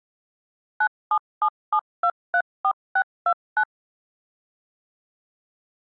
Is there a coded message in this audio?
Yes: DTMF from 0.8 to 3.6 s, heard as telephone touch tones, dialled by machine, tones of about 70 ms. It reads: 9777234629